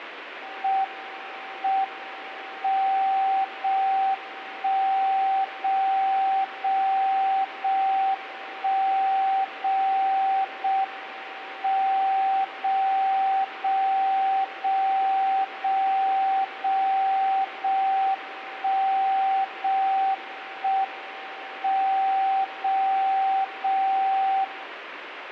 Radio time signal (JJY), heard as a tone whose level steps once a second, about 770 Hz, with radio static. The time is 05:24 Japan time. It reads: M M 0 1 0 0 0 1 0 0 M 0 0 0 0 0 0 1 0 1 M 0 0 0